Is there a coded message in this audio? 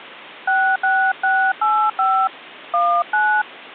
Yes: DTMF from 0.5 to 3.4 s, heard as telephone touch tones, dialled by hand, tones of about 290 ms. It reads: 66685 19